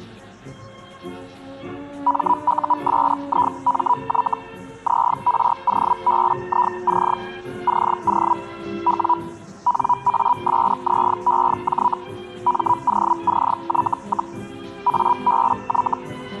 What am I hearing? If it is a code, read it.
Hellschreiber (Feld-Hell, 122.5 baud), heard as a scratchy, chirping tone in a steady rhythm, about 980 Hz. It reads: MUSIMY ZROBIC CO W NASZEJ MOCY, ABY